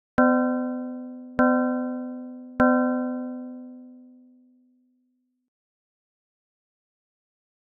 Clock strike, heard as a bell. 3. Three o'clock.